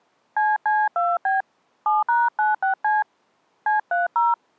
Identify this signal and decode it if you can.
DTMF, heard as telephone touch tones, dialled by hand, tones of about 170 ms. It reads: CC2B 7#96C C30